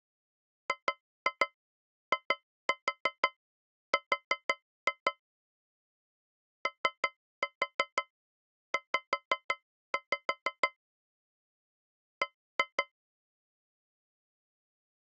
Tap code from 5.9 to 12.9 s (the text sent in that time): OZ B